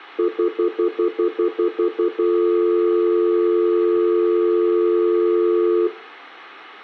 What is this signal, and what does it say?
Telephone call progress tone (North American plan), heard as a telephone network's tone, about 350, 440 Hz, 0.1 s on and 0.1 s off, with room echo. Stutter dial tone.